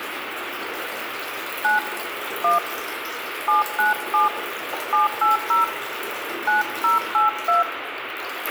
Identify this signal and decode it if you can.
DTMF, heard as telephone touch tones, dialled by hand, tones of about 140 ms, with radio hiss, a squelch burst at the end, room echo and the noise of a restroom. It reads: 9 1 797 780 9082